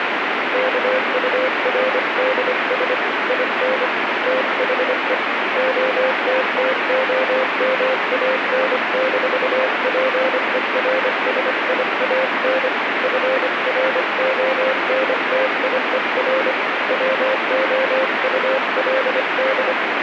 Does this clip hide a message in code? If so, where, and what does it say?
Yes: Morse code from 0.5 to 19.8 s, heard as a keyed tone, hand-sent with a paddle, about 25 wpm, 520 Hz, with heavy radio static. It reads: KURDS IN THE OTTOMAN-PERSIAN FRONTIER WOULD